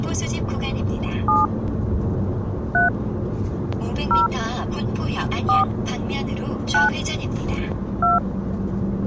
DTMF, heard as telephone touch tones, dialled by hand, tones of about 150 ms, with the noise inside a car. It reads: 7 3 0 4 9 2